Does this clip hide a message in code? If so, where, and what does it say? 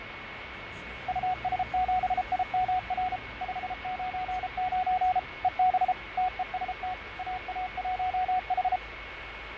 Yes: Morse code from 1.0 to 8.8 s, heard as a keyed tone, machine-sent, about 33 wpm, 740 Hz, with radio static, fading, a steady whistle near 2200 Hz and street noise. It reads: US7IMR 599 EB TEST AA1H